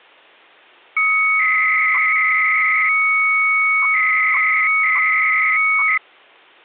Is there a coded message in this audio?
Yes: 300-baud modem data (Bell 103 tones) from 1.0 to 6.0 s, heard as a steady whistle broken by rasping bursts, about 300 baud, 200 Hz shift.